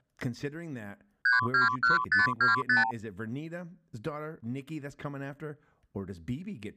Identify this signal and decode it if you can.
Multi-frequency trunk signalling (R2, with the far end's replies), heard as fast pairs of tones, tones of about 140 ms, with speech in English. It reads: 321525